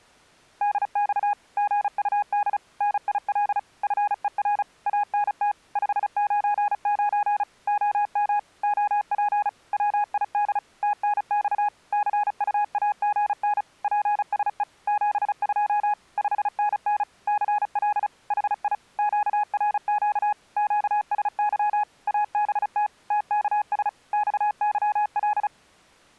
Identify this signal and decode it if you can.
Morse code, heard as a keyed tone, machine-sent, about 35 wpm, 830 Hz. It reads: DX GUD NIL FER ANT 599 OM OP WID TNX CUAGN PSE 72 5NN CL HI QRQ QSY ABT TKS XYL